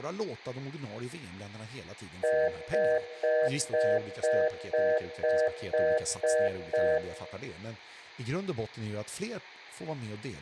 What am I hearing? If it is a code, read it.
Telephone call progress tone (North American plan), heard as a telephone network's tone, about 480, 620 Hz, 0.25 s on and 0.25 s off, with room echo and speech in Swedish. Congestion tone.